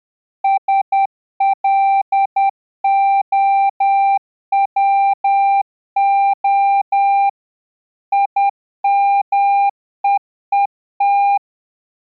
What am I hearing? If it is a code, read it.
Morse code (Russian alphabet), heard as a keyed tone, machine-sent, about 10 wpm, 790 Hz. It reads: СЛОВО ИМЕЕТ